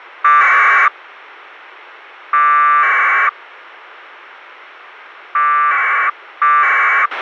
Packet radio (AX.25, as in APRS), 1200 baud, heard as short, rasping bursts, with a squelch burst at the end.